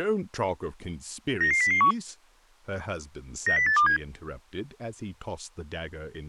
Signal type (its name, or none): five-tone selective call